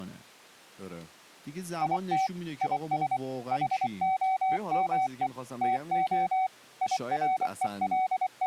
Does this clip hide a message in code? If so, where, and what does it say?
Yes: Morse code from 1.8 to 8.5 s, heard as a keyed tone, machine-sent, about 24 wpm, 750 Hz, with speech in Persian. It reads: IT IS HOME TO …